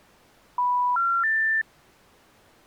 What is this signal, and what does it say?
Telephone call progress tone (North American plan), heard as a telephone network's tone, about 980, 1370, 1800 Hz. Special information tone.